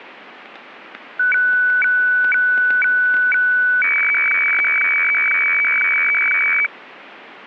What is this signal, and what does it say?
Weather fax (radiofax), 120 lines a minute, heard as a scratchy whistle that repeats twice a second, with static crashes.